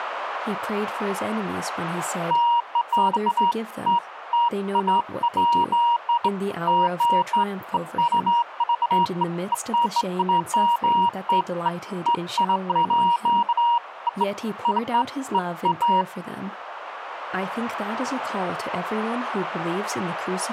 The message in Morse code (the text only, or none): none